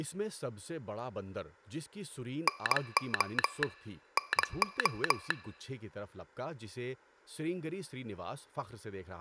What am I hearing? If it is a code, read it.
Morse code, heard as a telegraph sounder, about 22 wpm, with speech in Urdu. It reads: NO NO